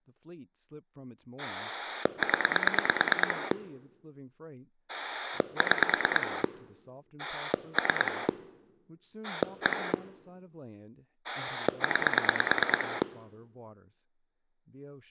Pulse dialling, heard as a rotary dial, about 9 pulses a second, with speech in English. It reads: 0 6 3 1 9